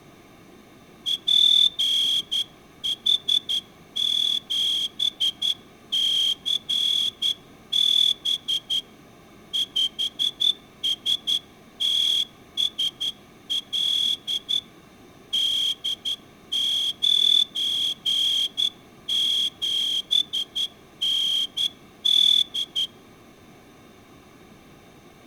Morse code, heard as a whistle, hand-sent with a straight key, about 11 wpm. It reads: PH7CB 5STSL D97ND